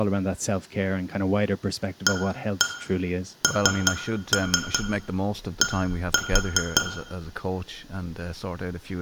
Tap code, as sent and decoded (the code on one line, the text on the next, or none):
1-1 3-3 1-4
AND